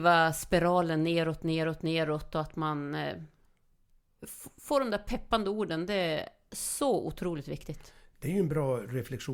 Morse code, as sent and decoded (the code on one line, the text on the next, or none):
none